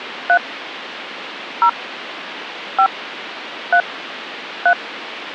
DTMF, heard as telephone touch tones, dialled by hand, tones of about 80 ms, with phone line noise. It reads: 3 0 5 3 3